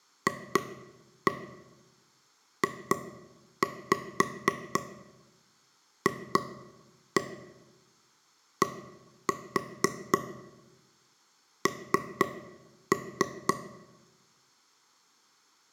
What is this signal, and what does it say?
Tap code, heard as taps on a table, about 4 knocks a second, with room echo. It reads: FJFDN